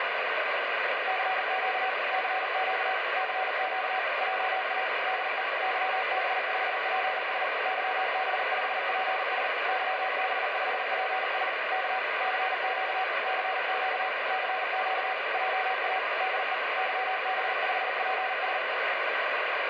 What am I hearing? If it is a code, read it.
Morse code, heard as a keyed tone, machine-sent, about 39 wpm, 750 Hz, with heavy radio static. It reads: CQ CQ CQ JA DE YB5PS YB5PS YB5PS K CQ CQ CQ JA DE YB5PS